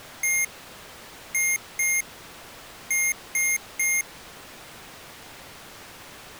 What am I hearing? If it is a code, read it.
Beep code, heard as beeps from a small speaker, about 2150 Hz. 1-2-3. In Phoenix BIOS tables: DMA page register failure.